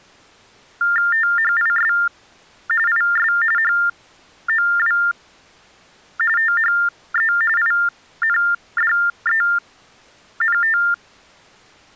TTY/TDD text telephone tones (45.45 baud Baudot), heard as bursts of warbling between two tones, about 400 Hz shift, 1600 Hz centre. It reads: THIS IS HOW THE INDENT